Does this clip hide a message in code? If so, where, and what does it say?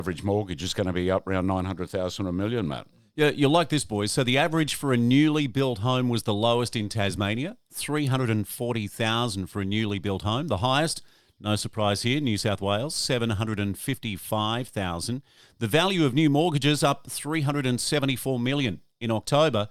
No, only speech in English.